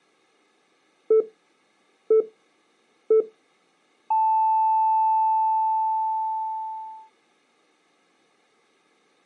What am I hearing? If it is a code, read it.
Radio time signal (three low pips and a long one an octave up, as on NHK), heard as pips.